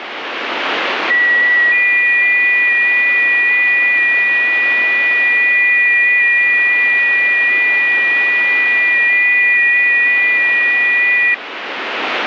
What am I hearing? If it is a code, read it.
FT8 (several signals at once), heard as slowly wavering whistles, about 6.25 baud, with radio static.